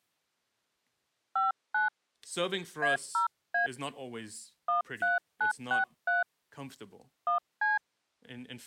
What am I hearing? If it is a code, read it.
DTMF, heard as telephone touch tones, dialled by hand, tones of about 140 ms, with speech in English. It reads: 59 A0A 13963 1C